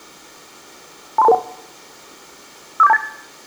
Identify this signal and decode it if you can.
Five-tone selective call (EIA), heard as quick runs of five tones, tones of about 30 ms, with room echo. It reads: 23221 54728